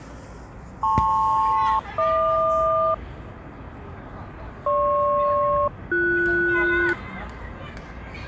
Aircraft SELCAL, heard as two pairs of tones, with the noise of a park. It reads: LP-HQ GP-BS